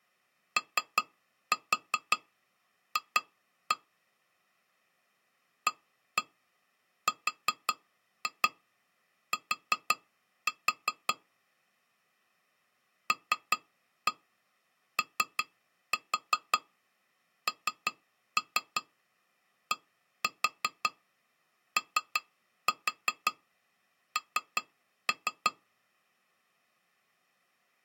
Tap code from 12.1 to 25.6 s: LONDON

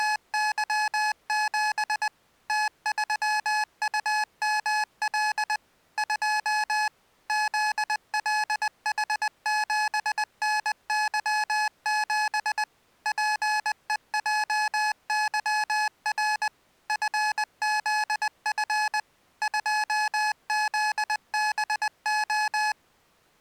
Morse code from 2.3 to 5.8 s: T3UML

